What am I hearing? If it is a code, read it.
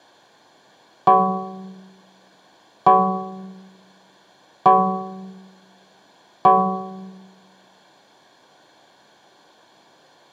Clock strike, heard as a bell, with room echo. 4. Four o'clock.